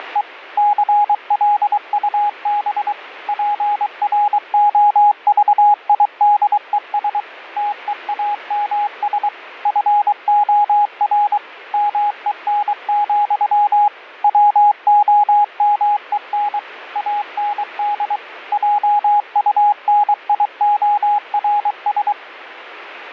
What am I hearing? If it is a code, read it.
Morse code, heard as a keyed tone, machine-sent, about 23 wpm, 830 Hz, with radio static. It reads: … CLUB PROVIDES TEAMS FOR MEN, WOMEN AND JUNIORS